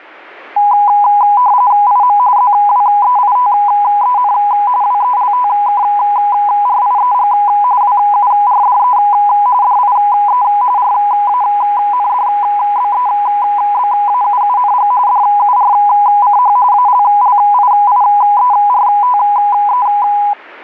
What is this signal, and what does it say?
RTTY (45.45 baud, 170 Hz shift), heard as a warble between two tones, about 910 Hz centre. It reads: IM ZWEITEN WELTKRIEG WURDE DIE RANDBEBAUUNG DURCH ALLIIERTE